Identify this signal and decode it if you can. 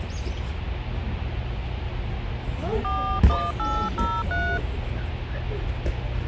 DTMF, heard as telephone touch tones, dialled by hand, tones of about 260 ms, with phone line noise and the noise of a park. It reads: 41803